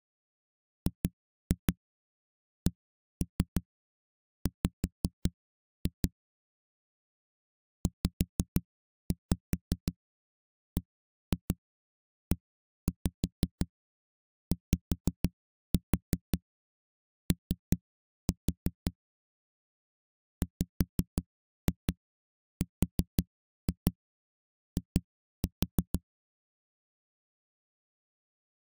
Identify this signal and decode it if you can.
Tap code, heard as knocks on a wall, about 5 knocks a second. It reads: GCW ZBEYO WRI